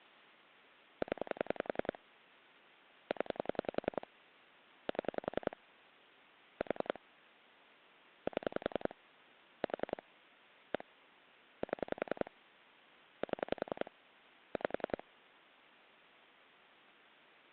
Pulse dialling, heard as clicks on a phone line, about 10 pulses a second. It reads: 0 0 7 4 7 4 1 7 7 5